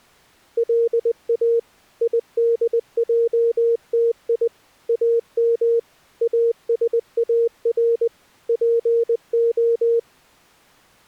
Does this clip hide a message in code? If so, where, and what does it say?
Yes: Morse code (Hebrew alphabet) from 0.5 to 10.1 s, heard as a keyed tone, machine-sent, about 20 wpm, 460 Hz. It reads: לא ידעתי אם אשאר פה